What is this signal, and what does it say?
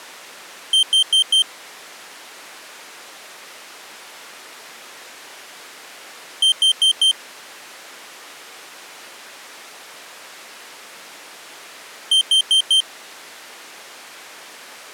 Alarm pattern, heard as an alarm's beeps, played three times, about 3150 Hz. Temporal four. Carbon monoxide.